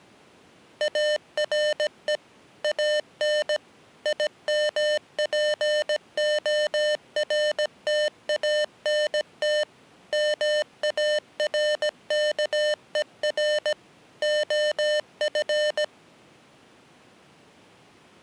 Morse code, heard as electronic beeps, machine-sent, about 17 wpm, 600 Hz. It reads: ARE AN IMPORTANT MARKER OF